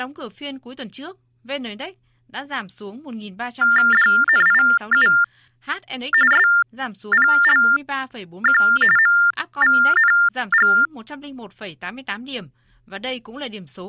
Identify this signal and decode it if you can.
TTY/TDD text telephone tones (45.45 baud Baudot), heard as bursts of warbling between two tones, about 400 Hz shift, 1600 Hz centre, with speech in Vietnamese. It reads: DNIU SPLQ MVNG